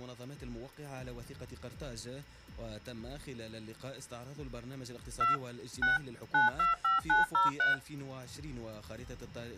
DTMF, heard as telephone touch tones, dialled by machine, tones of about 150 ms. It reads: 2 6 925903